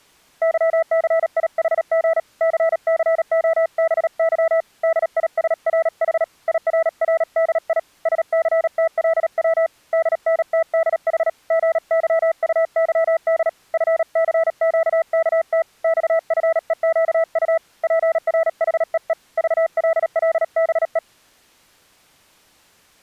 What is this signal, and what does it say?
Morse code, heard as a keyed tone, hand-sent with a paddle, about 37 wpm, 660 Hz. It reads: YCIHG CCOBY DISRH IRRDI SCTLW DNTDH GYUYD FCQKT XFEQU PRHEE VLLBE